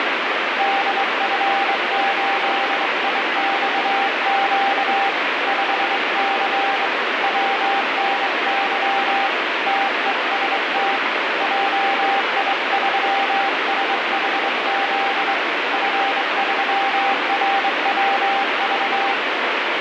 Morse code, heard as a keyed tone, hand-sent with a straight key, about 23 wpm, 790 Hz, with heavy radio static. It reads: DF8IXQ 5C WNY TEST JI3SHZ F3RWV